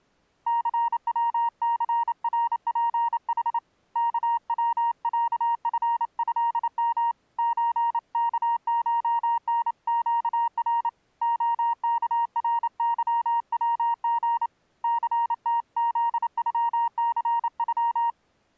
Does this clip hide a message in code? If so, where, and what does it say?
Yes: Morse code (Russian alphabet) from 0.4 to 18.2 s, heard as a keyed tone, hand-sent with a paddle, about 28 wpm, 940 Hz. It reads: ЦВЦРПХ КВЯФЭМ ЧКШНЩР ОКРЫВГ ЦТЗЮЦЮ